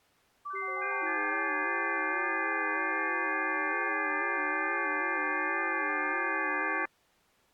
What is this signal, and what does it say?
FT8 (several signals at once), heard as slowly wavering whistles, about 6.25 baud.